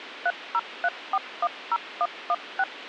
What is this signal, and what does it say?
DTMF, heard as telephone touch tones, dialled by machine, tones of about 50 ms, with radio hiss. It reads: 303410116